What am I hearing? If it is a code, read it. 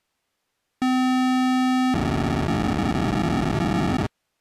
POCSAG pager data (512 baud), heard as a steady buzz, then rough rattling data.